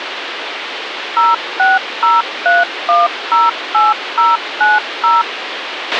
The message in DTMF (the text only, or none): 0603108090